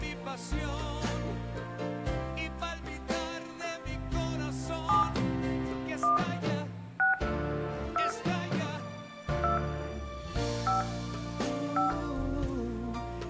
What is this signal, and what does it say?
DTMF, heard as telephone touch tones, dialled by hand, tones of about 140 ms, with room echo. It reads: 7 1 6 2 2 5 5